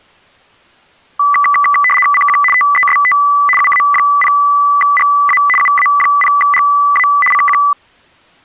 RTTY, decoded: CQ TEST UA0GA UA0GA CQ

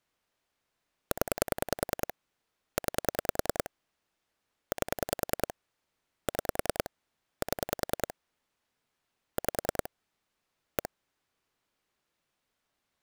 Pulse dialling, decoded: 0 9 8 6 7 5 1

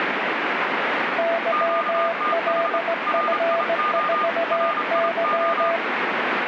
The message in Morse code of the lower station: YLF4Y

